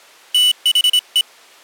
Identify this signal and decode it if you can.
Morse code, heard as a high beeper, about 26 wpm, 2950 Hz. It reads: THE